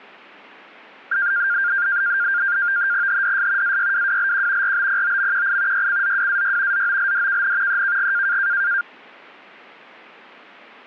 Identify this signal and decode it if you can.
NAVTEX (SITOR-B), 100 baud, 170 Hz shift, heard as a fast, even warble, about 1500 Hz centre. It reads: HDS AYWWLQ RBPOMQI YCZWAY ZOLDKN EKG